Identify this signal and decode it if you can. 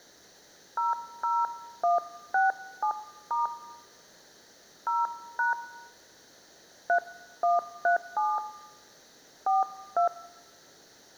DTMF, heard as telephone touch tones, dialled by hand, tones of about 150 ms. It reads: 00167* 0# 3137 42